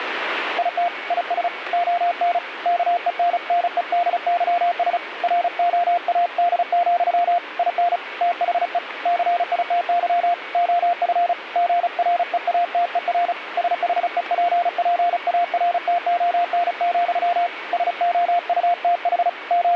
Morse code, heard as a keyed tone, hand-sent with a paddle, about 35 wpm, 700 Hz, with radio static and a weaker station near 2240 Hz. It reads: IT IS ON KENNEDYS ROAD, IN THE CITY OF GREATER SHEPPARTON, SOUTH …